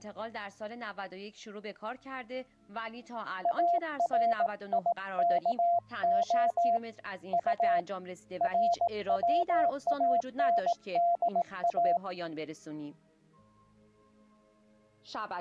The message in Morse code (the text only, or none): ARIKO U RWANDA